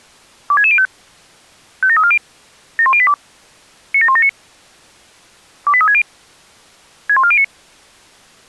Five-tone selective call (ZVEI), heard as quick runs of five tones, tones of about 70 ms. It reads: 26605 57340 71082 97179 28360 61409